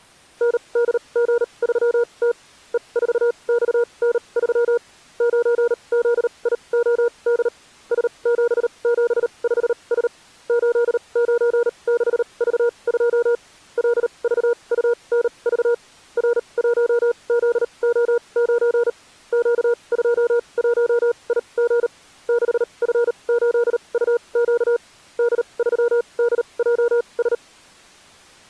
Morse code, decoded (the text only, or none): NDG3T E4XN3 9ZIOD S775S 896V2 LVUNV R1ZO9 Q21IG 6F8UQ D3DJS